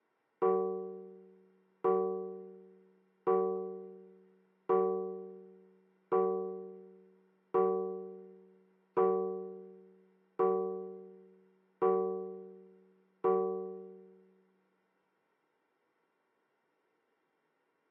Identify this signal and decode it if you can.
Clock strike, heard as a bell. 10. Ten o'clock.